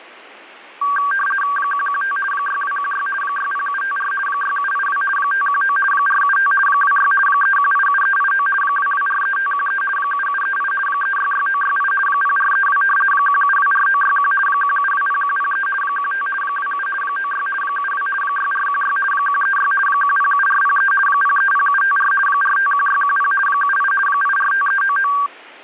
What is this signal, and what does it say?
RTTY (50 baud, 450 Hz shift), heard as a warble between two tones, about 1360 Hz centre. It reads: 115 6216 60754 6782 519 475 26 3187389 2243513 7738 366968 0432 1724961 1720103 15 27 96 72 6416 136 107403 030754 451610 78 845399